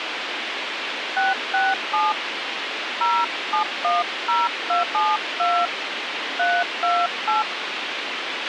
DTMF, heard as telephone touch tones, dialled by hand, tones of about 180 ms, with radio hiss and a squelch burst at the end. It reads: 667 0710272 328